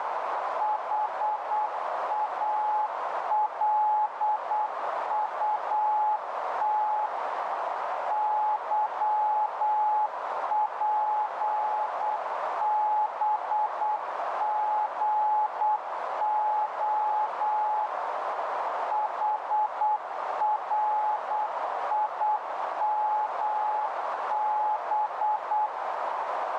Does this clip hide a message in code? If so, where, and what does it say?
Yes: Morse code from 0.5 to 25.7 s, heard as a keyed tone, machine-sent, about 8 wpm, 850 Hz, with heavy radio static and a narrow filter. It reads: HALUT YPBGO HRIMB